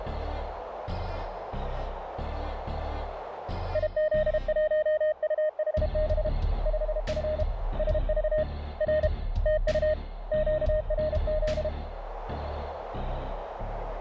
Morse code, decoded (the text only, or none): IZ1UHB 5F SV R TU QRZ